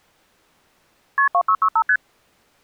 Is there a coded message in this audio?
Yes: multi-frequency trunk signalling (R1, as on North American trunks) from 1.2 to 2.0 s, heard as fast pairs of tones, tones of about 70 ms. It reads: KP 2665 ST